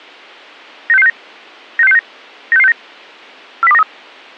Five-tone selective call (EEA), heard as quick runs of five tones, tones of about 40 ms. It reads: 96669 96669 96669 40293